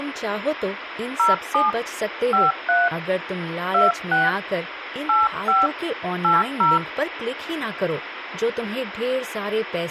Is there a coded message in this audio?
Yes: DTMF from 1.2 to 6.8 s, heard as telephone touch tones, dialled by hand, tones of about 180 ms, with phone line noise and speech in Hindi. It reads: 07 53 26 85 80